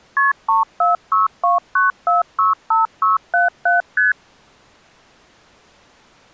Multi-frequency trunk signalling (R1, as on North American trunks), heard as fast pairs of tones, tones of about 150 ms. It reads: KP 34629465677 ST